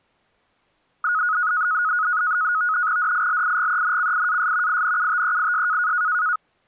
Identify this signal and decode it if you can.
NAVTEX (SITOR-B), 100 baud, 170 Hz shift, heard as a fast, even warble, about 1360 Hz centre. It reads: DILIGENCIAS INUTEIS